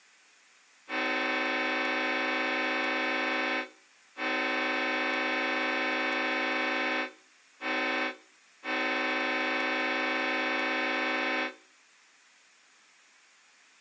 Train horn signal, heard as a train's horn. 2 long, 1 short, 1 long. On North American railways: approaching a public crossing.